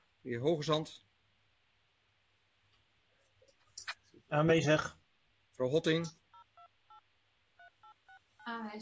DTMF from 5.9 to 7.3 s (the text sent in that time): 8028